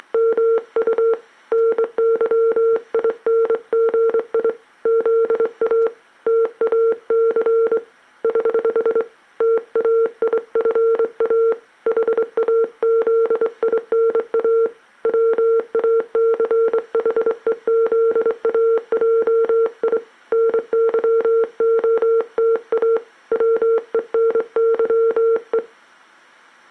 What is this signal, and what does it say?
Morse code, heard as a keyed tone, hand-sent with a straight key, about 24 wpm, 460 Hz. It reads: … NYINGI ZA TAC <HH> TAIFA HAZINA WACHEZAJI NYOTA WENYE